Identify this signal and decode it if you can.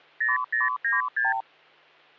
Multi-frequency trunk signalling (R2, with the far end's replies), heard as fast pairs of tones, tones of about 160 ms, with hum. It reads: 0096